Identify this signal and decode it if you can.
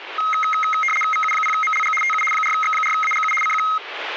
RTTY (75 baud, 850 Hz shift), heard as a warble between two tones, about 1700 Hz centre, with radio static. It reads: VU0MLG TU 4X4AGU CQ